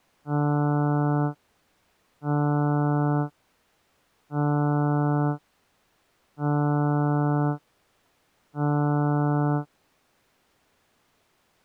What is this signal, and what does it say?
Ship horn signal, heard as a ship's horn, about 150 Hz. 5 short. At sea: I doubt that you are doing enough to avoid a collision.